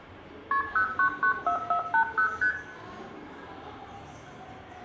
Multi-frequency trunk signalling (R1, as on North American trunks), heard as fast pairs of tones, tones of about 90 ms, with room echo and the noise of a crowd indoors. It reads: KP 0994480 ST